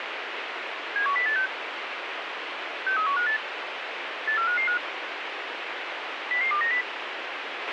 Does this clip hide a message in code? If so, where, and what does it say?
Yes: five-tone selective call (CCIR) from 1.0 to 6.8 s, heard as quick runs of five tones, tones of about 100 ms, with radio hiss and a squelch burst at the end. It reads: 71086 63158 84555 00290